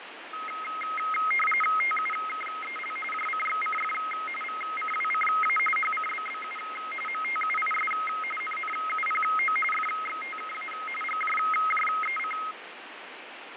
RTTY (45.45 baud, 850 Hz shift), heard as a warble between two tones, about 1700 Hz centre, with radio static and fading. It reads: TUKEL JCXCF VCWCA HCBBU MTUIS NNUPO FXTKA GJJEC